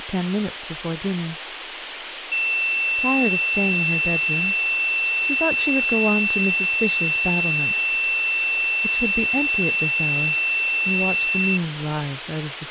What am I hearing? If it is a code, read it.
A steady tone, with phone line noise and speech in English. There is no code.